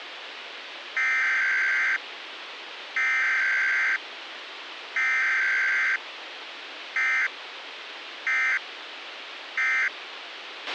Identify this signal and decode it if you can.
Emergency Alert System (SAME) tones (header bursts, then end-of-message bursts), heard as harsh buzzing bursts, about 520.83 baud, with radio hiss and a squelch burst at the end.